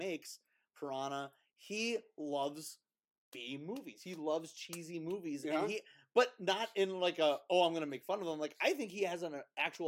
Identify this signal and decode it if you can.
Speech in English. There is no code.